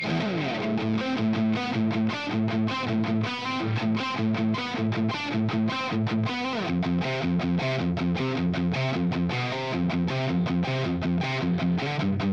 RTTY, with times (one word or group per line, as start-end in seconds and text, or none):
none